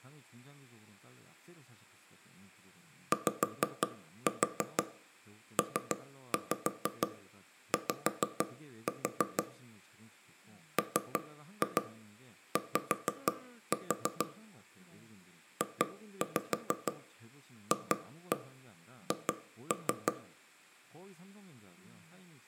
Tap code, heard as knocks on wood, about 6 knocks a second, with room echo and speech in Korean. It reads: YPY MY JFH